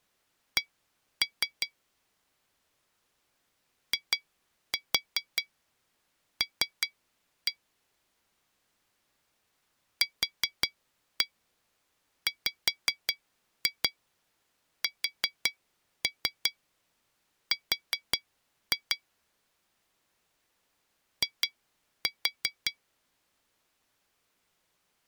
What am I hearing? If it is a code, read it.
Tap code, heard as taps on glass, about 5 knocks a second. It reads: C IL QWSR I